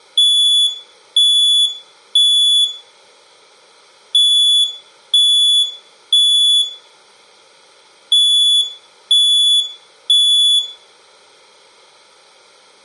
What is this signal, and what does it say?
Alarm pattern, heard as an alarm's beeps, played three times, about 3450 Hz, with room echo. Temporal three. Smoke or fire, evacuate.